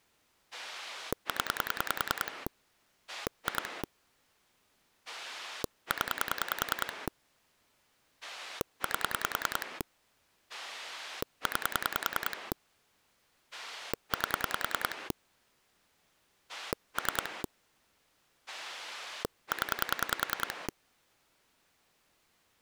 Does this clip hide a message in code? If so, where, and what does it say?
Yes: pulse dialling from 0.5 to 20.7 s, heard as a rotary dial, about 10 pulses a second. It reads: 0 2 0 8 9 8 3 0